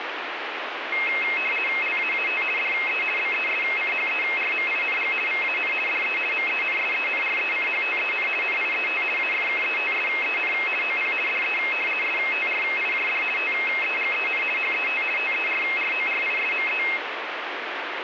RTTY (50 baud, 450 Hz shift), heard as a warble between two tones, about 2350 Hz centre, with radio static. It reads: LAAT DE BESCHERMING VAN DE MENSENRECHTEN NIET AFKETSEN OP DE STRIJD TEGEN HET TERRORISME